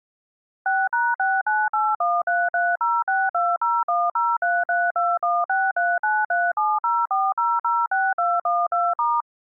DTMF, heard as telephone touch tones, dialled by machine, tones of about 220 ms. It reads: 6#69813306201033216393704006212*